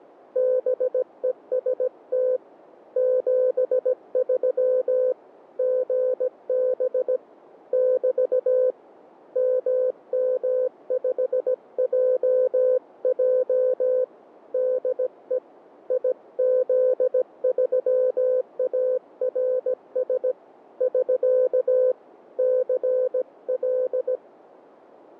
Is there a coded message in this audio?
Yes: Morse code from 0.3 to 24.2 s, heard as a keyed tone, hand-sent with a paddle, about 17 wpm, 510 Hz. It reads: BEST 73 GB <BT> MM5JJ DE IZ3ARS <SK> CL